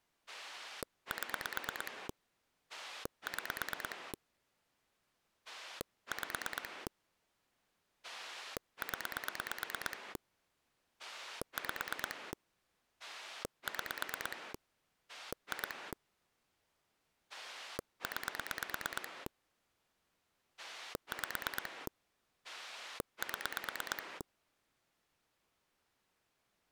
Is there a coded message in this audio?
Yes: pulse dialling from 0.3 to 24.2 s, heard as a rotary dial, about 9 pulses a second. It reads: 7 6 5 0 5 6 2 9 5 7